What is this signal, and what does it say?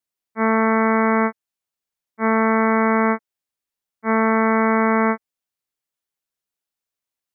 Ship horn signal, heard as a ship's horn, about 220 Hz. 3 short. At sea: I am operating astern propulsion.